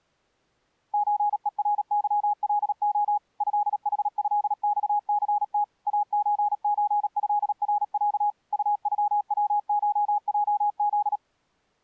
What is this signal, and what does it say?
Morse code (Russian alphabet), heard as a keyed tone, machine-sent, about 37 wpm, 830 Hz. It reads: ЧЕРЫЛО ЭХЭЬЦТ АЧЧЭРЯ УЮВШЙЗ